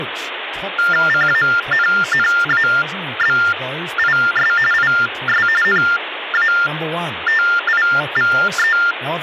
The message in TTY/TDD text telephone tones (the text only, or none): CANNABIS IS NATIVE